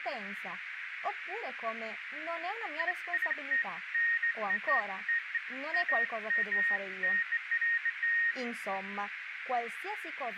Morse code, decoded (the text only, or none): none